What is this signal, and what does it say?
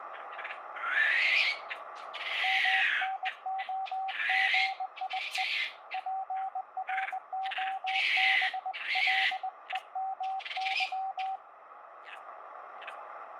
Morse code (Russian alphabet), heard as a keyed tone, hand-sent with a bug key, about 20 wpm, 770 Hz, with radio static. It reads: МНОГИЕ ПРОБЛЕМЫ